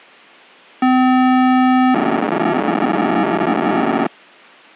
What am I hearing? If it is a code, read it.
POCSAG pager data (512 baud), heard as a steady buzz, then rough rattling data.